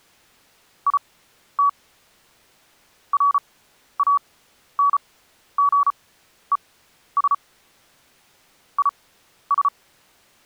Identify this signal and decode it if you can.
Morse code, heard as a keyed tone, machine-sent, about 34 wpm, spaced as for 12 wpm, 1140 Hz. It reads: IT RANGES IS